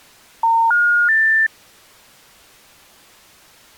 Telephone call progress tone (North American plan), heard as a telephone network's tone, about 910, 1430, 1800 Hz. Special information tone.